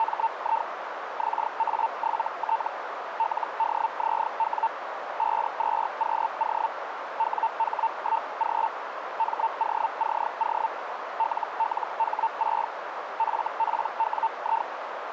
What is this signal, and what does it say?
Hellschreiber (Feld-Hell, 122.5 baud), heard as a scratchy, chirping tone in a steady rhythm, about 900 Hz, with radio static and a narrow filter. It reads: … XA7T LDZW 52QO WH1G MOCO LLH6 FPWI